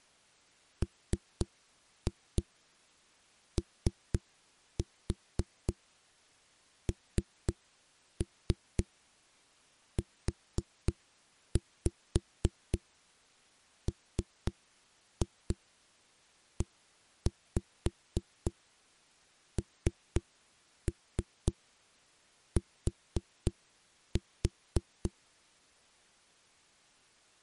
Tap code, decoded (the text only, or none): MONUMENT